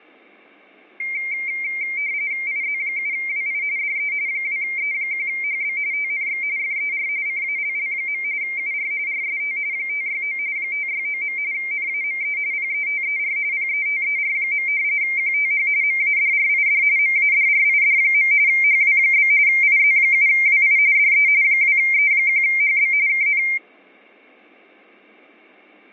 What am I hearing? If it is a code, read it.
RTTY (45.45 baud, 170 Hz shift), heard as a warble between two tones, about 2200 Hz centre, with fading. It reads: IZ7WI DE 2E1HB TNX FER CALL. UR RST 569 569. NAME PETER PETER. QTH MADRID MADRID. HW? IZ7WI DE 2E1HB KN